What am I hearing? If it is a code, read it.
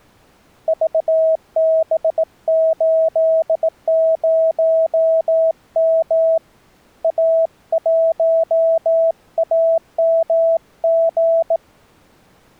Morse code, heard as a keyed tone, hand-sent with a bug key, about 18 wpm, 650 Hz. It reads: VB80M A1AMG